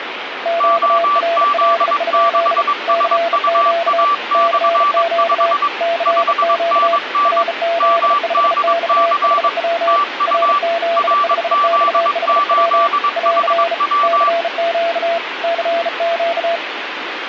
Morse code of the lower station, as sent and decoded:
--.- .-. .-.. ..--.. / -.-. --.- / -.-. --.- / -.-. --.- / .-. --.. ..... -..- .... .-- / .-. --.. ..... -..- .... .-- / .-.-. / -.-. --.- / -.-. --.-
QRL? CQ CQ CQ RZ5XHW RZ5XHW <AR> CQ CQ

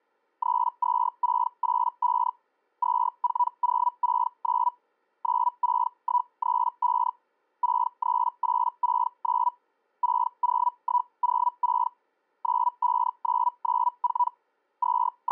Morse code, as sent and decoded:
none

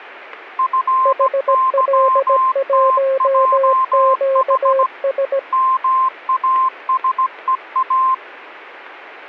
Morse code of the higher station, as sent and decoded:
..-. -.-- - .--- .... / -- .- ... . .-
FYTJH MASEA

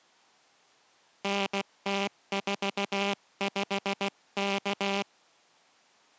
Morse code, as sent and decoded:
-. - ....- ..... -.-
NT45K

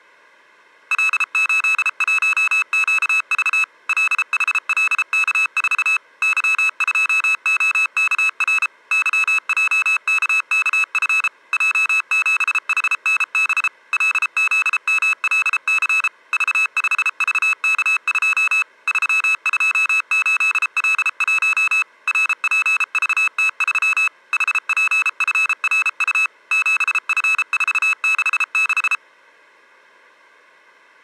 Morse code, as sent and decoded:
.-.. ---.. .---- --.- ...- / .-.. .... .-.. -.- ....- / -.-- ..--- --- -.- .-. / -.-- .--- -.- -.- ..-. / .--- --... .... -. -... / .-.. --.. -- .-.. -.-. / ...- ..... ...- -.- ..--- / ...-- ..--- ---.. .-.. .---- / .-. .--. ...- - ...-- / .... .--. ..-. .-. ..- / --... ..-. ....- -.... -....
L81QV LHLK4 Y2OKR YJKKF J7HNB LZMLC V5VK2 328L1 RPVT3 HPFRU 7F466

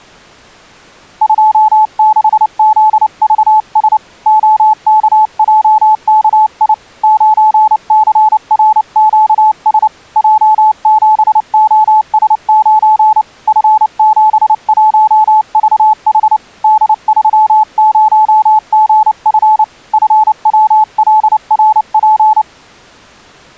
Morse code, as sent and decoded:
..--- -.... --.. ...- ... / --- -.- .--- -.- .. / ----. -.-. .-. --.- ... / .--- --... --- ... ----. / ..-. --... .---- ...- .... / -.. ...-- ----- --. ..-. / ..-. .-- .-.. .-. .--.
26ZVS OKJKI 9CRQS J7OS9 F71VH D30GF FWLRP

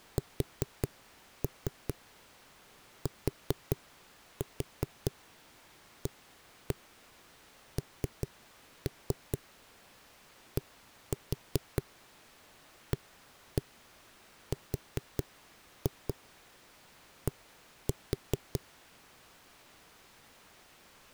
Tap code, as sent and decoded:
4-3 4-4 1-1 3-3 1-4 1-1 4-2 1-4
STANDARD

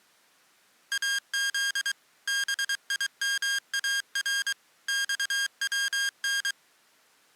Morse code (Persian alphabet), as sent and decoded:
.- --.. / -... .. -- .- .-. / -..- .-- -.
از بیمار خون

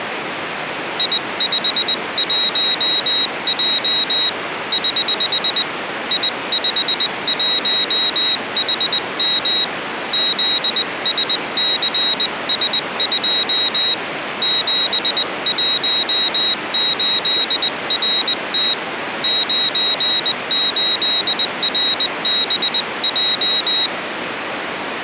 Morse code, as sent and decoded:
.. ..... .---- .--- / ........ / .. ..... .---- .... -- / --.. ... -.-. ... ..--- / --... .---- ---.. .-. - / ----. ---.. .-. -... .---
I51J <HH> I51HM ZSCS2 718RT 98RBJ

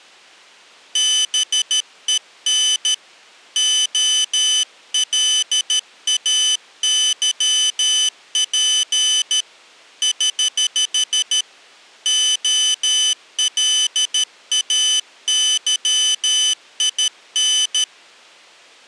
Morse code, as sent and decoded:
-... . -. / --- .-.. .- -.-- .--. / ........ / --- .-.. .- -.-- .. -.
BEN OLAYP <HH> OLAYIN

